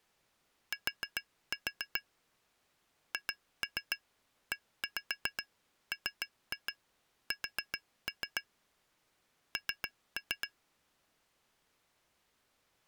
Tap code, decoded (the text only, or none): T HEMS N